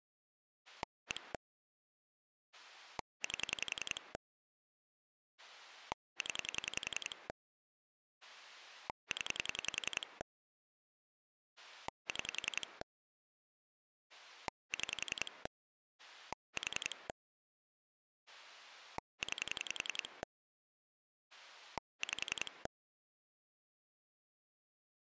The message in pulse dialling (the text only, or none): 1 8 0 0 6 6 4 9 5